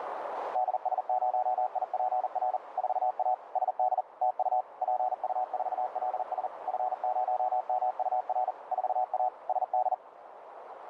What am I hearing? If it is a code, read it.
Morse code, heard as a keyed tone, machine-sent, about 40 wpm, 740 Hz, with radio static and a narrow filter. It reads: DS0IPR 4A SD TU PU4LS F0MUR 4A SD